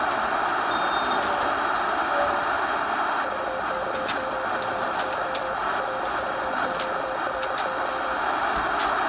Morse code, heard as a keyed tone, machine-sent, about 31 wpm, 520 Hz, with radio static and the noise of a restaurant. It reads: VKMGY RVQRY